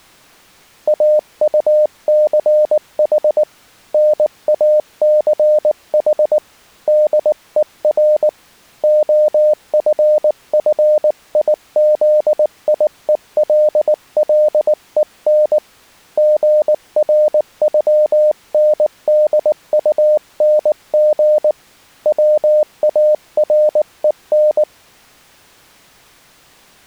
Morse code (with German letters), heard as a keyed tone, hand-sent with a paddle, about 19 wpm, 610 Hz. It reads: AUCH NACH DER OFFIZIELLEN GRÜNDUNG WAREN